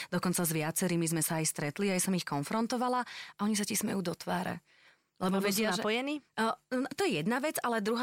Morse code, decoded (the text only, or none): none